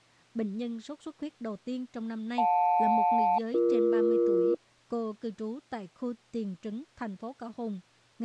Aircraft SELCAL, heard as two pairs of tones, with speech in Vietnamese. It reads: JL-BE